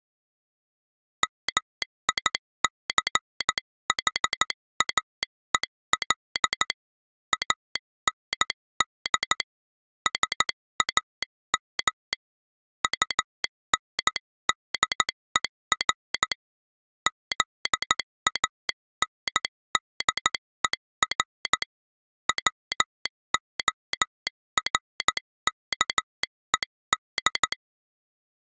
Morse code, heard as a telegraph sounder, hand-sent with a paddle, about 14 wpm. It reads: MICHAEL AND SAM UNDER ZANDER WORKED